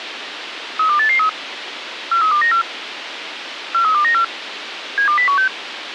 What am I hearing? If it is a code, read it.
Five-tone selective call (CCIR), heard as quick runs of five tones, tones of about 100 ms, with radio hiss. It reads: 32883 43294 43294 72016